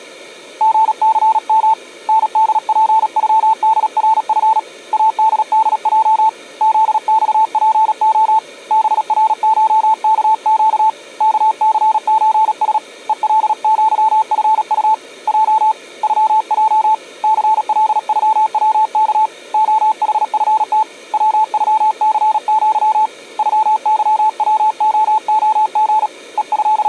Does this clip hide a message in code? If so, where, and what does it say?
Yes: Morse code (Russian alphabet) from 0.5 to 26.9 s, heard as a keyed tone, hand-sent with a paddle, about 37 wpm, 880 Hz. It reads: ГЦМ НДПЮДРФ АДДЙ ЗЬПО БРШКЩ КЦЧС ЕЛЪФУ Й ЮЙ ЦЛЮВК ОХФТ ВЮЦЪ ЮЫВООГ …